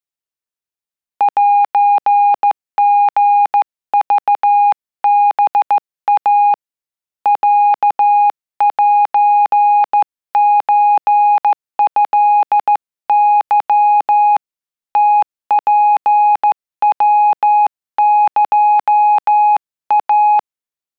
Morse code (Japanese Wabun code), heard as a keyed tone, hand-sent with a straight key, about 14 wpm, 830 Hz. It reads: セリクハイ ロセソトケ ムツヤエイ